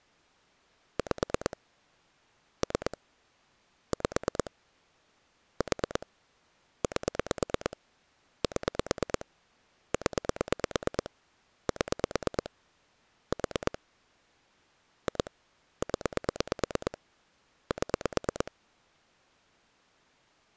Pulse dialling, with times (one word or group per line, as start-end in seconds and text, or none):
1.0-1.6 5
2.6-3.0 3
3.9-4.5 5
5.6-6.1 4
6.8-7.8 8
8.4-9.3 7
9.9-11.1 0
11.7-12.5 7
13.3-13.8 4
15.1-15.3 2
15.8-17.0 0
17.7-18.5 7